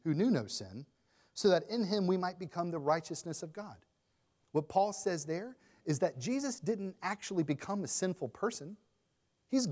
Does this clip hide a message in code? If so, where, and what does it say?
No, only speech in English.